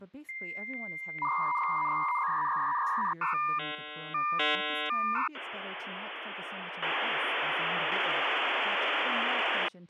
Dial-up modem handshake (V.34 or later), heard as a whistle, warbles, then hiss, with speech in Korean.